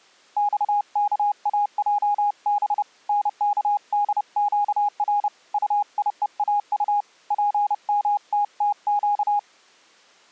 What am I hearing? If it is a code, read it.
Morse code, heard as a keyed tone, hand-sent with a paddle, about 30 wpm, 820 Hz. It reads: XKAJB NKDQR UIEAU PMTTQ